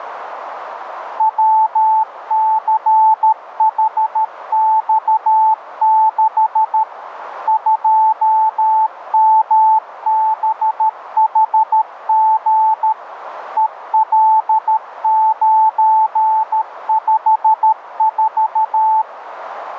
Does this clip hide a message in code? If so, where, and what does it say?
Yes: Morse code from 1.1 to 19.1 s, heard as a keyed tone, machine-sent, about 13 wpm, 880 Hz, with radio static. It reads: WCHX6 2MBHG EL954